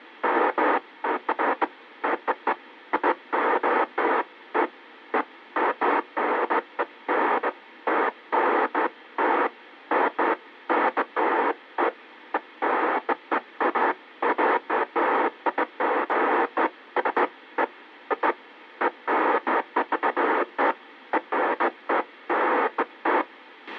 Bursts of noise, with a squelch burst at the end. There is no code.